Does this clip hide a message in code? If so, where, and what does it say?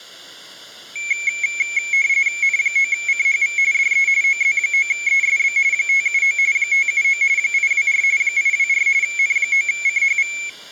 Yes: RTTY (45.45 baud, 170 Hz shift) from 1.0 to 10.5 s, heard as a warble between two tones, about 2250 Hz centre, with room echo. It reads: N9CHV DE OZ9ESB 579 579 824 824 N9CHV